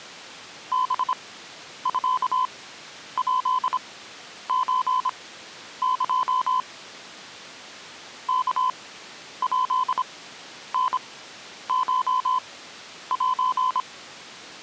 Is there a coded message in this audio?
Yes: Morse code (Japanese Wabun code) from 0.7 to 13.9 s, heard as a keyed tone, machine-sent, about 26 wpm, spaced as for 10 wpm, 1020 Hz. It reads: ハミヱソエ ワヱタコセ